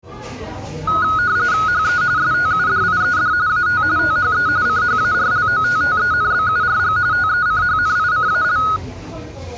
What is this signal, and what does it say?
RTTY (45.45 baud, 170 Hz shift), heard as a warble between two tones, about 1360 Hz centre, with the noise of a crowd indoors. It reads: HE STUDIED AT THE CHARLOTTENBURG TECHNICAL